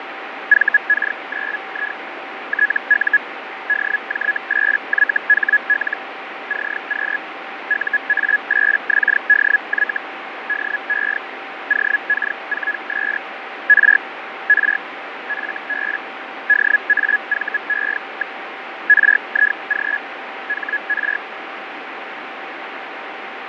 Hellschreiber (Feld-Hell, 122.5 baud), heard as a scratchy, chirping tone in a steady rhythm, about 1700 Hz, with radio static and fading. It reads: VK9I TU DJ8YHL CQ UA8XDY DE OK4S R R FB DAVE. RIG HR